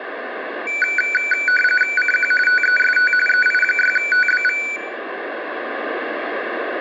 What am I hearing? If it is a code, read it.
RTTY (45.45 baud, 850 Hz shift), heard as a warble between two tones, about 1900 Hz centre, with radio static and room echo. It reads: CQ TEST EI6TBV